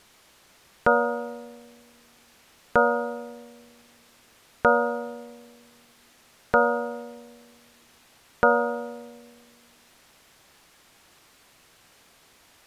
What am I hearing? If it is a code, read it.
Clock strike, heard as a bell. 5. Five o'clock.